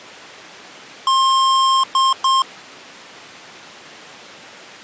Beep code, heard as beeps from a small speaker, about 1060 Hz. 1 long, 2 short. In Award, IBM and AMI BIOS tables: video adapter failure.